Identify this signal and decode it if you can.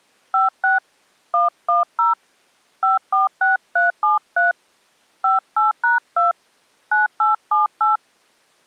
DTMF, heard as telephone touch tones, dialled by hand, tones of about 150 ms. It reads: 56 110 546373 58#2 9878